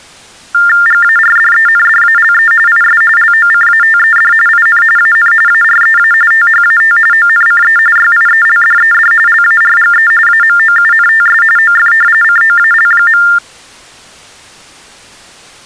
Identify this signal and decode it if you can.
TTY/TDD text telephone tones (45.45 baud Baudot), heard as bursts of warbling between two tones, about 400 Hz shift, 1600 Hz centre. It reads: GARDENDALE IS LOCATED IN AN AREA THAT ONCE YIELDED LARGE AMOUNTS OF COAL.